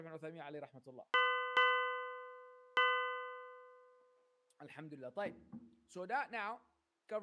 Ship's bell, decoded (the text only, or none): 3